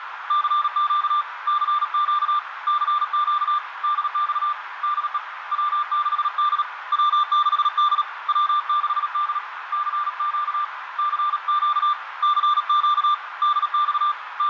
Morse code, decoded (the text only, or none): CQ CQ CQ DX DE W6D W6D W6D CQ CQ CQ DX …